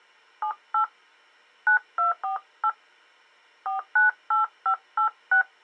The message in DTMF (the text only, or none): 78 9248 498586